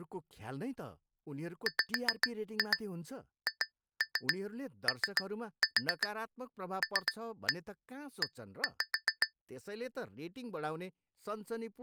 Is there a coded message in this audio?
Yes: tap code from 1.7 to 9.3 s, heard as taps on glass, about 7 knocks a second, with speech in Nepali. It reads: WHOLE